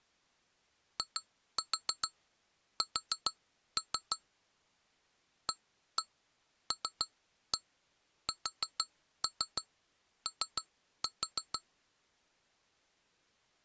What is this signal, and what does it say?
Tap code, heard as taps on glass, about 6 knocks a second. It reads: IS ALSO